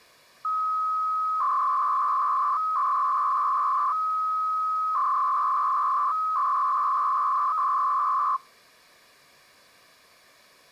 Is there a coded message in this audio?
Yes: 300-baud modem data (Bell 103 tones) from 0.4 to 8.4 s, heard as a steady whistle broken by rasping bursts, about 300 baud, 200 Hz shift.